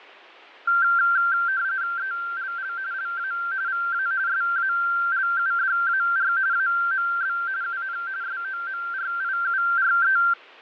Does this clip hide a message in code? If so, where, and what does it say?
Yes: RTTY (45.45 baud, 170 Hz shift) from 0.7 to 10.3 s, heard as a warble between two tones, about 1470 Hz centre, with fading. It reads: ELL LA VA SALUDAR AMB UN SOMRIURE